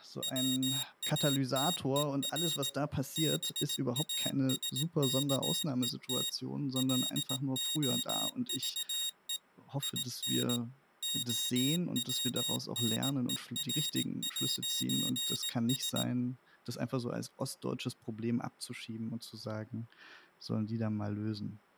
Morse code, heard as a high beeper, machine-sent, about 18 wpm, 3750 Hz, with speech in German. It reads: WATER BASKET LOVE IN OWNER'S